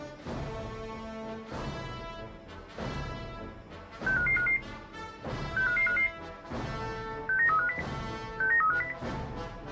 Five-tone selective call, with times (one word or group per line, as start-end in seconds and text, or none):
4.1-4.6 65555
5.6-6.1 65555
7.3-7.8 69350
8.4-8.9 69350